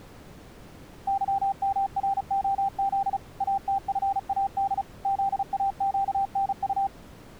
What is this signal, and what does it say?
Morse code, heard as a keyed tone, machine-sent, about 35 wpm, 790 Hz. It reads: YMROZ ATFAD ZAQNU